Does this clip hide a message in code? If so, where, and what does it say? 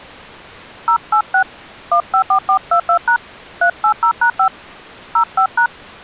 Yes: DTMF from 0.9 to 5.7 s, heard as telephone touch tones, dialled by hand, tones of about 90 ms. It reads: 086 154422# 380#5 05#